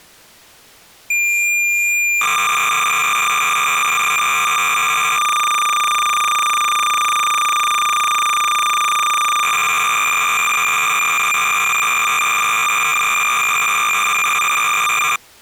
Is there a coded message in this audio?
Yes: cassette data (Kansas City type), 300 baud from 1.1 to 15.2 s, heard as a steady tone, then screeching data.